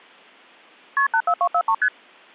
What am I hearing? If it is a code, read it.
Multi-frequency trunk signalling (R1, as on North American trunks), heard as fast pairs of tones, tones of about 70 ms. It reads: KP 84243 ST